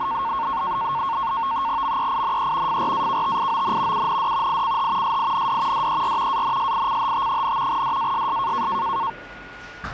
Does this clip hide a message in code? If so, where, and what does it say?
Yes: NAVTEX (SITOR-B), 100 baud, 170 Hz shift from 0.0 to 9.1 s, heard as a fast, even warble, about 1000 Hz centre, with a steady whistle near 1440 Hz and the noise of a cafe. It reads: MEINE FRAKTION UND ICH SIND DER ANSICHT, DASS